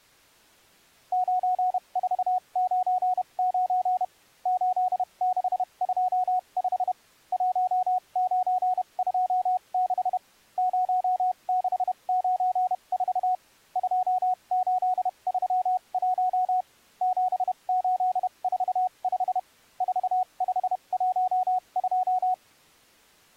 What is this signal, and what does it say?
Morse code, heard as a keyed tone, machine-sent, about 31 wpm, spaced as for 26 wpm, 740 Hz. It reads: 9499 8625 1926 0694 2831 7845 4512